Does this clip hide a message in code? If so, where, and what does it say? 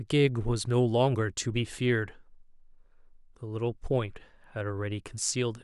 No, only speech in English.